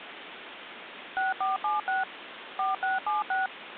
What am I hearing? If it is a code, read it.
DTMF, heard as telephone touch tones, dialled by machine, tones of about 160 ms, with phone line noise. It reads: 6476 4676